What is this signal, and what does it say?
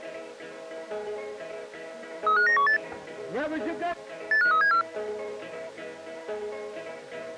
Five-tone selective call (CCIR), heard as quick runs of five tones, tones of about 100 ms. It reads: 35918 85374